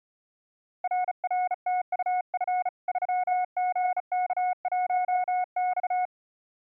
Morse code, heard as a keyed tone, hand-sent with a bug key, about 35 wpm, 730 Hz. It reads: RRTUF 3GK1X